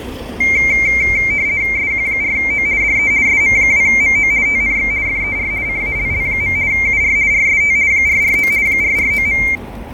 RTTY (50 baud, 170 Hz shift), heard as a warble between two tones, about 2200 Hz centre, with fading and street noise. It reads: SQ4O DE SM2MO TNX FER CALL. UR RST 449 449.